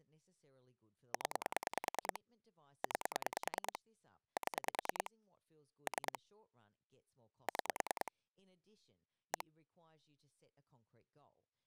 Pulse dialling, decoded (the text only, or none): 0 9 7 3 6 1